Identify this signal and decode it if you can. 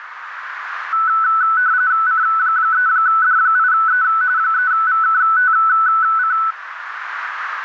RTTY (45.45 baud, 170 Hz shift), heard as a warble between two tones, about 1400 Hz centre, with radio static and a narrow filter. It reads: C3D8E 3VKTC